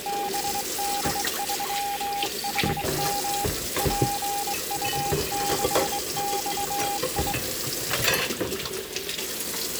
Morse code, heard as a keyed tone, hand-sent with a straight key, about 22 wpm, 810 Hz, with kitchen noise. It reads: BD3HM PU6XI